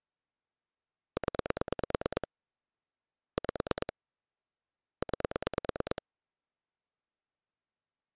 Pulse dialling, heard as clicks on a phone line, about 9 pulses a second. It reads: 0 5 9